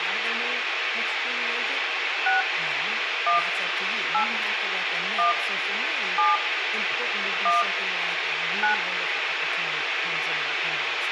DTMF, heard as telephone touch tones, dialled by hand, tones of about 160 ms, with radio hiss, room echo and speech in English. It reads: 6 1 8 1 7 1 9